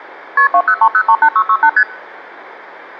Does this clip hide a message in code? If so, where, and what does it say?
Yes: multi-frequency trunk signalling (R1, as on North American trunks) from 0.4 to 1.8 s, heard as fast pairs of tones, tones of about 70 ms, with hum. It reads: KP 203038668 ST